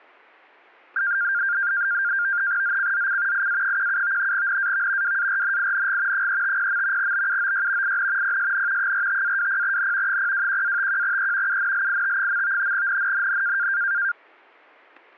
NAVTEX (SITOR-B), 100 baud, 170 Hz shift, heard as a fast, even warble, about 1500 Hz centre, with static crashes. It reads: ZCZC IA17 NAV WARNING 350. BUOY IN PSN 45-20N 021-51E UNLIT. NNNN